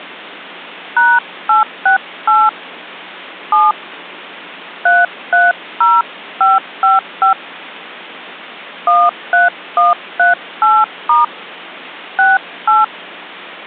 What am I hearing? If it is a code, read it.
DTMF, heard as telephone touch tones, dialled by hand, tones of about 170 ms. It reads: #868 7 330555 13138* 68